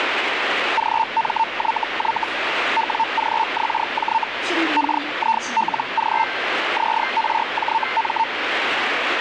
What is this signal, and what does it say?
Hellschreiber (Feld-Hell, 122.5 baud), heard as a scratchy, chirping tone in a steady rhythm, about 900 Hz, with radio static and the noise inside a subway train. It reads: GMYY WGXJ KILG ZRJM